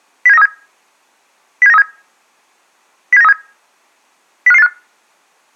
Five-tone selective call (EEA), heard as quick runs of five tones, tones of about 40 ms. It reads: 07937 07937 07937 05585